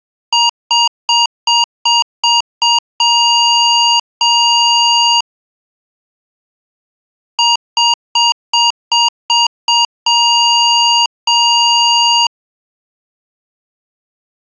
Beep code, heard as beeps from a small speaker, played twice, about 940 Hz. 7 short, 2 long.